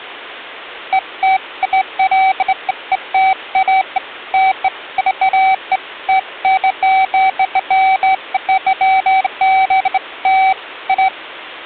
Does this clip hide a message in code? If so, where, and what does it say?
No, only beeps of irregular length.